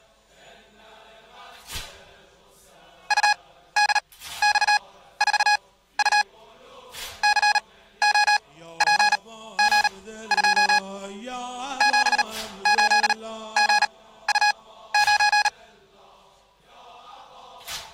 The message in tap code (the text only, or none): none